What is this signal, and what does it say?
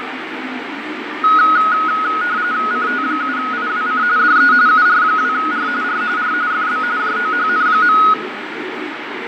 RTTY (45.45 baud, 170 Hz shift), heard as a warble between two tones, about 1360 Hz centre, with radio static, fading and the noise of a park. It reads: CT7IWC DE UR2R R R FB JOHN.